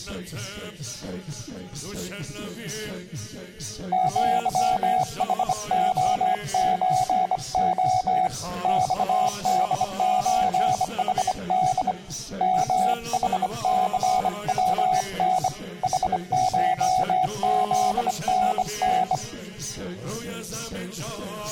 Morse code (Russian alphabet), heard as a keyed tone, hand-sent with a bug key, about 25 wpm, 740 Hz, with room echo. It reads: ЪХОЧО ЬДЧХД МХЦВН ХШЗНН